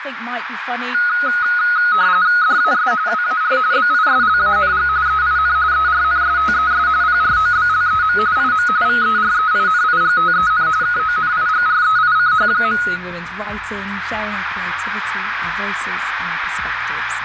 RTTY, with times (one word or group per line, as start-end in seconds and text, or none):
2.4-2.9 DAS
3.1-3.6 WAR
3.7-4.9 BISLANG
5.1-5.6 EIN
5.7-6.9 ERNSTES
7.0-8.2 PROBLEM
8.4-8.7 IM
8.9-10.7 VEREINIGTEN
10.8-12.8 KONIGREICH.